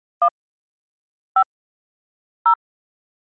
DTMF, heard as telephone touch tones, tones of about 80 ms. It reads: 1 5 0